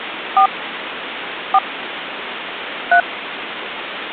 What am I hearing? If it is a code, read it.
DTMF, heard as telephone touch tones, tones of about 70 ms, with phone line noise. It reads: 4 4 3